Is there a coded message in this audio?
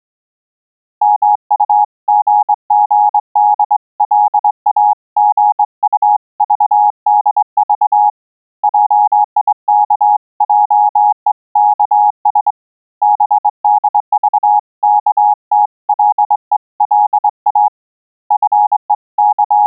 Yes: Morse code (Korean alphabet) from 1.0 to 19.7 s, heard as a keyed tone, hand-sent with a straight key, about 23 wpm, 840 Hz. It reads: 미쓰고시를 향하여 들어가고 …